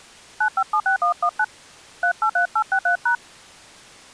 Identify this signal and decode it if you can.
DTMF, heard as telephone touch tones, dialled by hand, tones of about 90 ms. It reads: 9576119 383863#